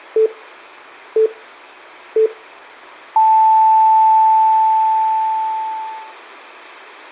Radio time signal (three low pips and a long one an octave up, as on NHK), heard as pips, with room echo.